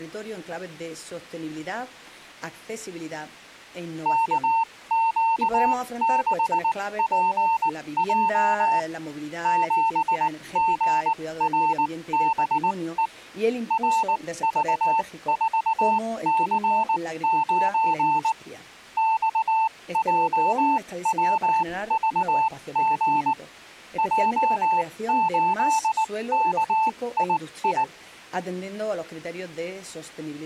Morse code, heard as a keyed tone, machine-sent, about 19 wpm, spaced as for 16 wpm, 890 Hz. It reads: KQ6PJ 7GRBE RV4C9 XJWVG J8KII